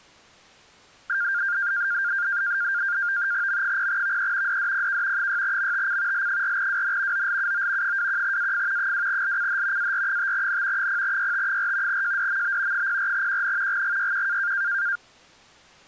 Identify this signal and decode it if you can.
NAVTEX (SITOR-B), 100 baud, 170 Hz shift, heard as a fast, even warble, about 1500 Hz centre. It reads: M0VE DDPK 6MTC L4WN OLUO 21AF 2LCH AR5N 0YT4 JDMB 04QN GGYQ